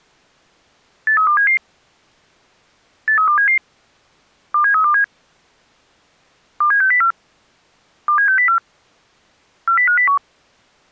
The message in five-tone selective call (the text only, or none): 83277 83277 27327 27604 27604 40501